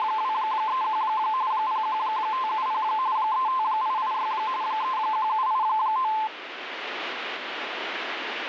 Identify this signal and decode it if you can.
RTTY (45.45 baud, 170 Hz shift), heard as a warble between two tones, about 960 Hz centre, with radio static. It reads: … 01570 35886 31789